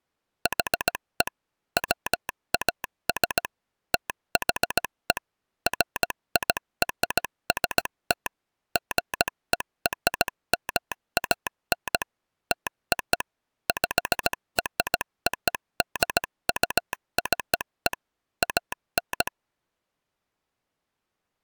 Morse code (American railroad code), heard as a telegraph sounder, machine-sent. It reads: HE WAS THE FIRST GERMAN TO PRODUCE AN